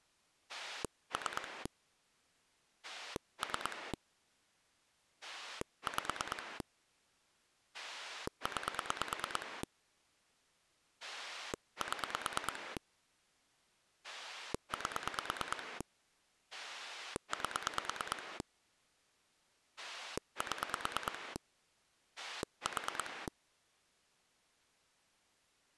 Pulse dialling, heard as a rotary dial, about 9 pulses a second. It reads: 3 3 5 9 7 8 8 7 4